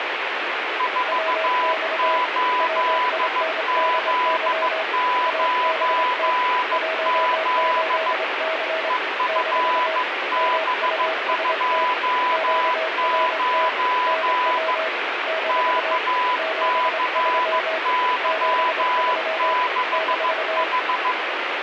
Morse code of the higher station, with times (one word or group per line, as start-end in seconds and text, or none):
0.8-8.1 48Z9Z
8.9-14.7 EFB29
15.5-21.1 KCY6H